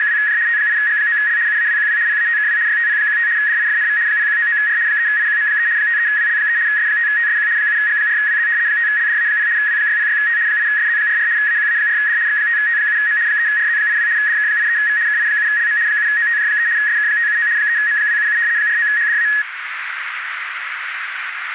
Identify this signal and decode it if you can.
RTTY (75 baud, 170 Hz shift), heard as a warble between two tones, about 1800 Hz centre, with radio static and a narrow filter. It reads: … T8G9L UAWQW PATKW YTP15 DIFNV 0199R 3IQM3 53WL3 S5TSQ 7G4WZ 5LDA0 W606T 8SZ44 AQA4D X5T7M 3RZ82 DK83V KI7LM 7OTJ3 SK579 3M277 49HDA